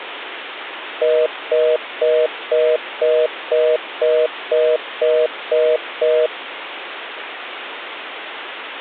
Telephone call progress tone (North American plan), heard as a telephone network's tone, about 480, 620 Hz, 0.25 s on and 0.25 s off, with phone line noise. Congestion tone.